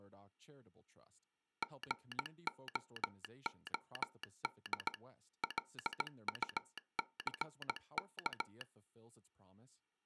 Morse code, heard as a telegraph sounder, machine-sent, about 17 wpm, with speech in English. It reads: GOOD LUCK